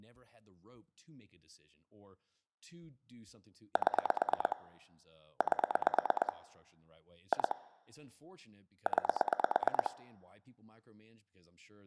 Pulse dialling, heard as clicks on a phone line, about 9 pulses a second, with speech in English. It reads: 7 8 2 9